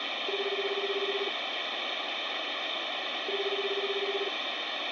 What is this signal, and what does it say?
Telephone call progress tone (Japanese plan), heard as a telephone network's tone, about 380, 400, 420 Hz, 1 s on and 2 s off, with phone line noise. Ringback tone.